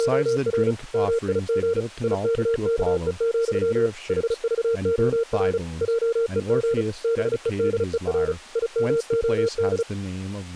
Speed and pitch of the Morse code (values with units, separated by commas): 35 wpm, 460 Hz